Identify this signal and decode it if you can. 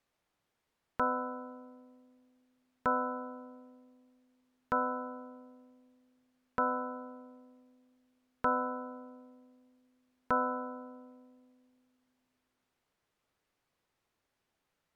Clock strike, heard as a bell. 6. Six o'clock.